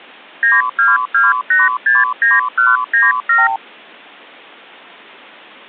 Multi-frequency trunk signalling (R2, with the far end's replies), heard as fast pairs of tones, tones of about 180 ms. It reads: 922869197